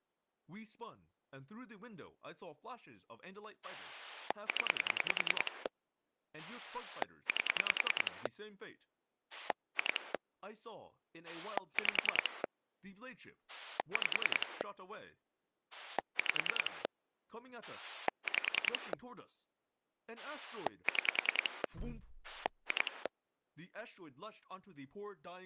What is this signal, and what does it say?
Pulse dialling, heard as a rotary dial, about 10 pulses a second, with speech in English. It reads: 0 8 2 5 5 5 5 6 2